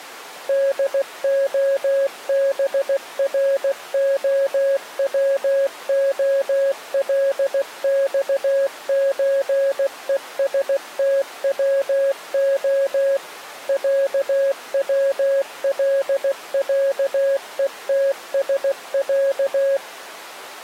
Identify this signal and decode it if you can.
Morse code (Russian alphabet), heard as a keyed tone, machine-sent, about 16 wpm, 550 Hz. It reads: ДОБРОВОЛЬЧЕСТВО ЯВЛЯЕТСЯ